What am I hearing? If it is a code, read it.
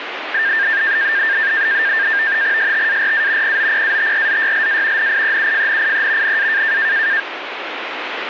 NAVTEX (SITOR-B), 100 baud, 170 Hz shift, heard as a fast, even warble, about 1700 Hz centre, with radio static. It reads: STARA POPATRZYLA NIEUFNIE NA